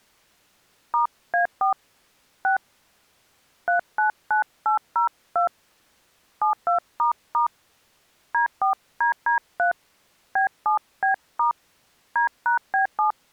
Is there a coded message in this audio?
Yes: DTMF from 0.9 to 13.1 s, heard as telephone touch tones, dialled by hand, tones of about 120 ms. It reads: *A4 6 399802 72** D4DD3 B7B* D#B7